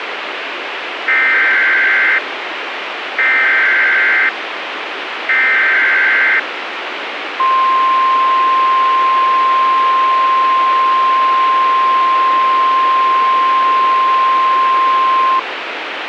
Emergency Alert System (SAME) tones (header bursts, then the 1050 Hz attention tone), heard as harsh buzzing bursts, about 520.83 baud, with radio hiss.